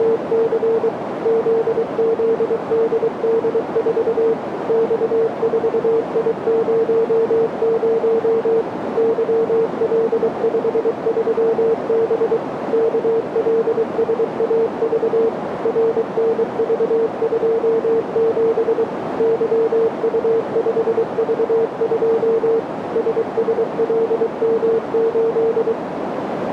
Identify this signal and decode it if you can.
Morse code, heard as a keyed tone, machine-sent, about 23 wpm, 450 Hz, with radio static and a narrow filter. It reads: … ZZDD4 X4I00 YL53B KLSAV RNV27 YU5V2 SSLM8